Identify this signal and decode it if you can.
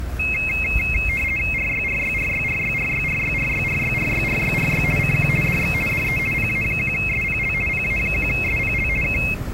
RTTY (50 baud, 450 Hz shift), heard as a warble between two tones, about 2350 Hz centre, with the noise of a residential street. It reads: RYRYRYRYRYRYRYRYRYRYRY CQ DX DE PA1SPL PA1SPL K